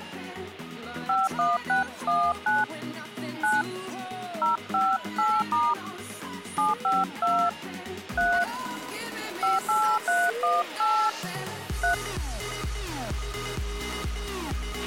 DTMF, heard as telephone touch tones, dialled by hand, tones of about 200 ms, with a squelch burst at the end. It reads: 51619 9 058* 752 3 58318 3